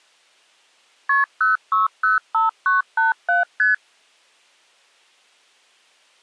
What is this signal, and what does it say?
Multi-frequency trunk signalling (R1, as on North American trunks), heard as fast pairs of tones, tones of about 150 ms. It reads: KP 0605987 ST